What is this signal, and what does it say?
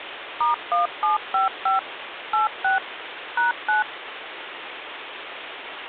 DTMF, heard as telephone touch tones, dialled by machine, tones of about 140 ms, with phone line noise. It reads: *1755 86 #9